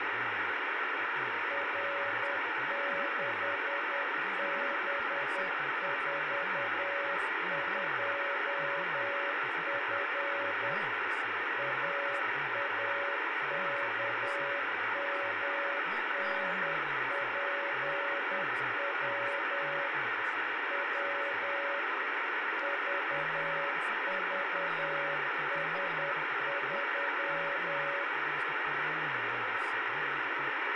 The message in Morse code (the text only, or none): R6B42F AAKMNPW W VVS3